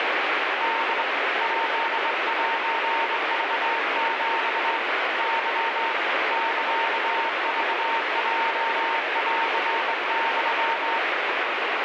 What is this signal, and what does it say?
Morse code (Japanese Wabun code), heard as a keyed tone, hand-sent with a straight key, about 23 wpm, 910 Hz, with heavy radio static. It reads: ホ ヱセクヒ ケ サクヲンユ